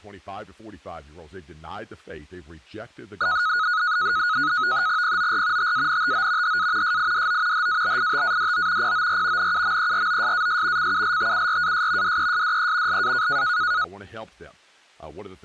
NAVTEX (SITOR-B), 100 baud, 170 Hz shift, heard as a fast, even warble, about 1360 Hz centre, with speech in English. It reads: POR TANTO HA SIDO HABITADO POR NUMEROSAS CULTURAS DESDE LA